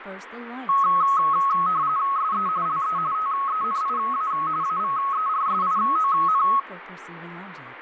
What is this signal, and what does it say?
RTTY (45.45 baud, 170 Hz shift), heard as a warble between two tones, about 1190 Hz centre, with radio static and speech in English. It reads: SE LE TENIA AVERSION